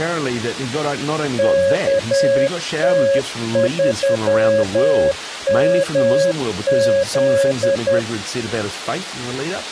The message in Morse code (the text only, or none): KT3MZ